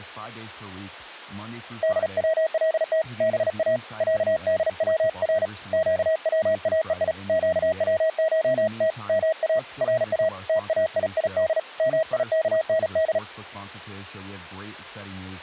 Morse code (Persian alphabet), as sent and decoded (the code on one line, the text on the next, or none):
-.. .-- .-.. - / -... .- / .-.- -.. .-- .-. / --.- .-- .- . .. / --.- .-- ---- - / -- .- / .-. .- / - .- .. .. -.. / -- .. -.- -. -..
دولت با صدور گواهی گوشت ما را تایید میکند